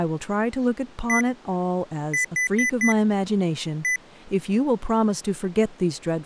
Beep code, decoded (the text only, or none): 1-4-1